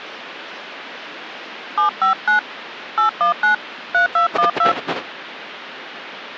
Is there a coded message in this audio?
Yes: DTMF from 1.8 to 4.7 s, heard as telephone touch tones, dialled by hand, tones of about 120 ms, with the noise of a residential street. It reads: 759 819 3212